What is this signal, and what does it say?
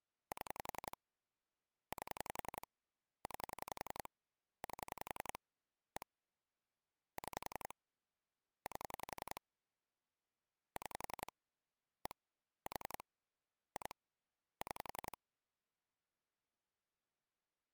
Pulse dialling, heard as clicks on a phone line, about 11 pulses a second. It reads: 7 8 9 8 1 6 8 6 1 4 2 6